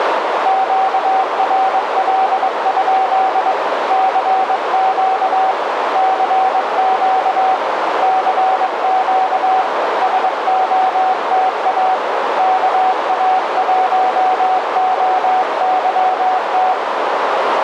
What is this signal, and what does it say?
Morse code, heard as a keyed tone, hand-sent with a paddle, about 22 wpm, 760 Hz, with heavy radio static and a narrow filter. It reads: QRL? CQ CQ CQ SOTA KA1OYT